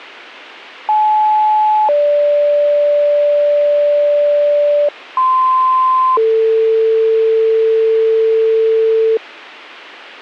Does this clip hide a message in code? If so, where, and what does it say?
Yes: two-tone page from 0.9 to 9.2 s, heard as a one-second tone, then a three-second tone, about 860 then 580 Hz, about 1040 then 450 Hz.